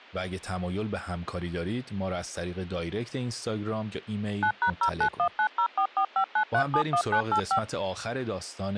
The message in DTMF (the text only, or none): 9#091904459371985